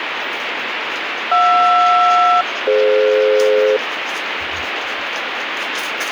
Aircraft SELCAL, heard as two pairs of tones, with radio static and the noise of a restroom. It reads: JR-DF